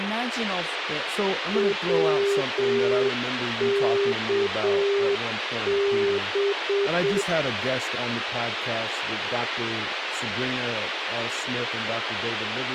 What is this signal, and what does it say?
Morse code, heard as a keyed tone, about 7 wpm, 400 Hz, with radio hiss and speech in English. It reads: WKB